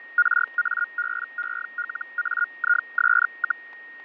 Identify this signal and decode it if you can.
Hellschreiber (Feld-Hell, 122.5 baud), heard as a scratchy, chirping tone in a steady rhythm, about 1430 Hz, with fading and a steady whistle near 1860 Hz. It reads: RABELAIS,